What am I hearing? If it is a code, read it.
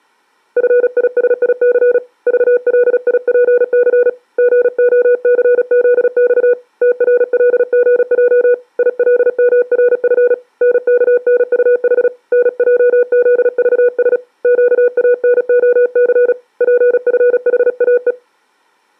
Morse code, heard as a keyed tone, hand-sent with a paddle, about 36 wpm, 490 Hz. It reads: FISIC VLIPC GOCZX TRLGJ ILMRF NKNUH NJZVS QANOC PFHAE